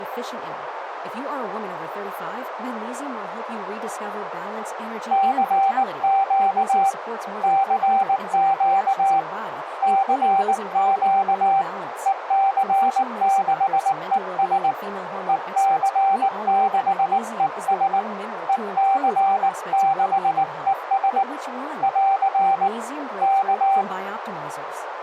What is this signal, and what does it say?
Morse code, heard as a keyed tone, hand-sent with a paddle, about 19 wpm, 780 Hz, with radio static, a narrow filter and speech in English. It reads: CQ CQ CQ EC6ES EC6ES EC6ES <AR> K